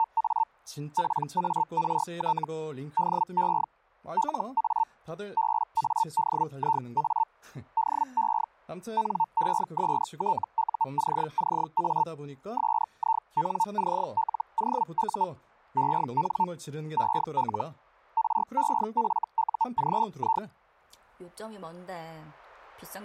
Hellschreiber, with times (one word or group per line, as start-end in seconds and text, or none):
0.0-0.4 …
1.0-2.4 PART
3.0-3.6 DE
4.2-4.8 LA
5.4-7.2 BADIA
7.8-8.4 DE
9.0-12.0 NESTUCCA
12.6-15.2 SINCLOU
15.8-16.4 EN
17.0-17.6 EL
18.2-20.4 REFUGI